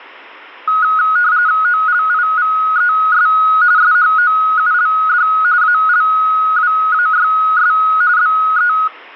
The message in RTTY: OLIVES SHOULD ALWAYS BE

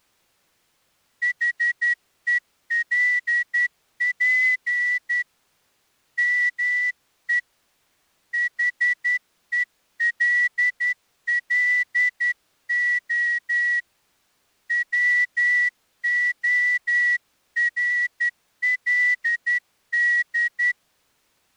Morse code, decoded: HELP ME HELLO WORLD

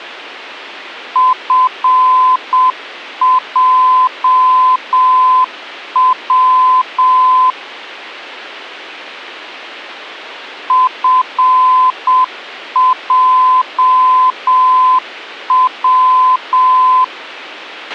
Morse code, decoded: FJW FJW

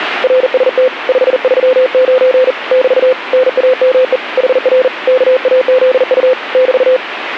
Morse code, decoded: RST 539 <BT> NAME HR KAZU <BT>

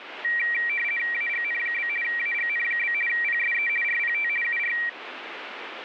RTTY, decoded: AGN? AGN? PSE RPT UR

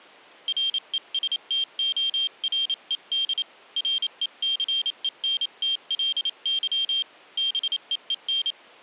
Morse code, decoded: RESTORED RECENTLY BEEN

